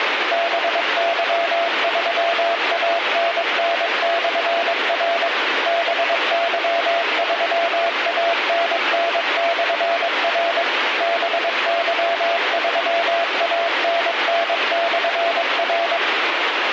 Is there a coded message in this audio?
Yes: Morse code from 0.3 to 16.0 s, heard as a keyed tone, machine-sent, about 22 wpm, 680 Hz, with radio static. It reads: BY3ANN/R BY3ANN/R BY3ANN/R